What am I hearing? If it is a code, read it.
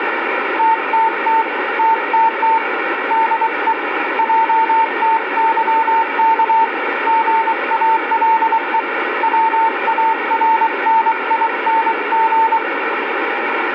Morse code, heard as a keyed tone, hand-sent with a paddle, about 23 wpm, 900 Hz, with radio static. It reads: TTT TTT DE JTYK GALE WARNING